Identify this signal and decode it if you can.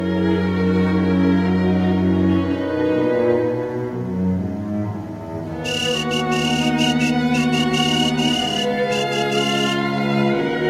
Morse code (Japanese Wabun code), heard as a whistle, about 13 wpm, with room echo. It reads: キノウ